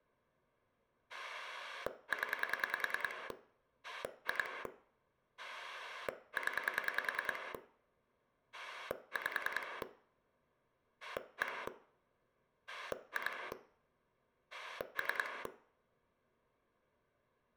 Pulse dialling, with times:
1.1-3.3 0
3.8-4.7 2
5.4-7.5 0
8.5-9.8 5
11.0-11.7 1
12.7-13.5 2
14.5-15.5 3

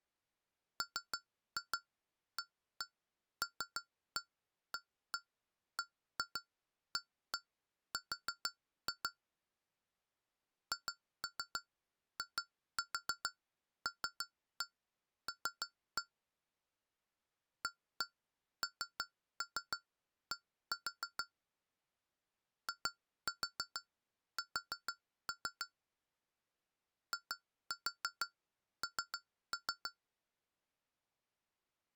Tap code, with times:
0.8-9.1 MALABAR
10.7-16.0 HILL
17.6-21.2 AND
22.7-25.7 IS
27.1-29.9 IN

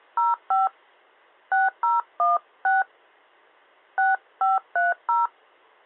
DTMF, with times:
0.2-0.7 05
1.5-2.8 6016
4.0-5.3 6530

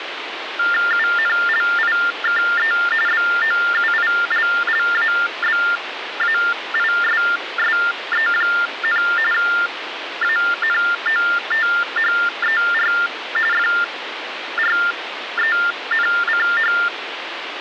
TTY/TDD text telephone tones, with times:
0.9-2.7 UNLIKE
3.1-9.0 BOUILLABAISSE,
9.3-12.9 ANOTHER
13.5-16.7 FRENCH

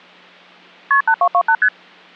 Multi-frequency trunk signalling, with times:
0.9-1.0 KP
1.1-1.5 8228
1.6-1.7 ST

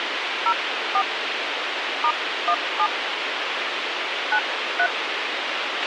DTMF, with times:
0.5-1.0 04
2.0-2.9 *17
4.3-4.9 93

